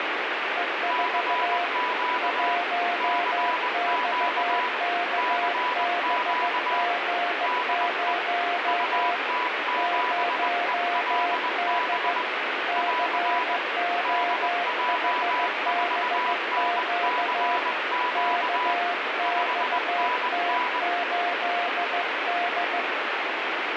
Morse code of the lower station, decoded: E4 1XKBG0 0D COHBQ KXT8D

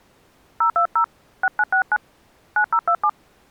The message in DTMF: 020 6969 9027

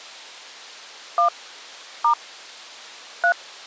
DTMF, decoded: 1 * 3

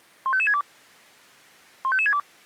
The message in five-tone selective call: 15562 15562

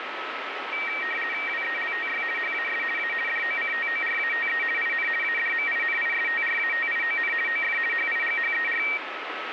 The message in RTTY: WELTY HAS A DOCTORATE IN ADMINISTRATION OF HIGHER

